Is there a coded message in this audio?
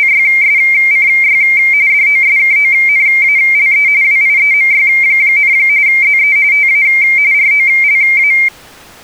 Yes: RTTY (45.45 baud, 170 Hz shift) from 0.0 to 8.5 s, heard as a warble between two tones, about 2200 Hz centre. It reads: … DOSKONALE WIEMY, ZE TA ROLA